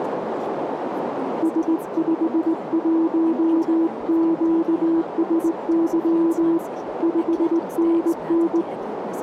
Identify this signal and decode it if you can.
Morse code, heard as a keyed tone, hand-sent with a straight key, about 19 wpm, 330 Hz, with radio static and a narrow filter. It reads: S51QSY 5NN